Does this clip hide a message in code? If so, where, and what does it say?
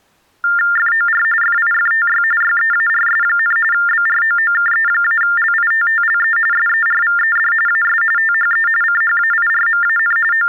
Yes: TTY/TDD text telephone tones (45.45 baud Baudot) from 0.4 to 10.5 s, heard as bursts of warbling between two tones, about 400 Hz shift, 1600 Hz centre. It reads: FOR FIFTY YEARS, BROOKE-LITTLE SERVED AS THE CHAIRMAN …